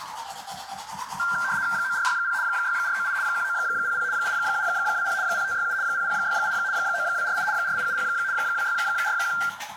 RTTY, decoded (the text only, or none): 9460 6498 1900 8720 0567 0068 9248 4870 2641